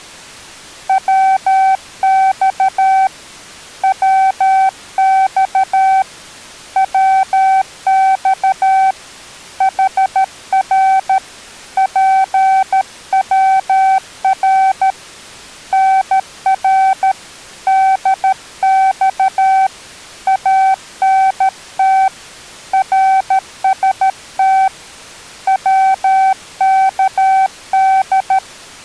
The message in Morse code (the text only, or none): WX WX WX HR PWR NR DX ANT RST WKD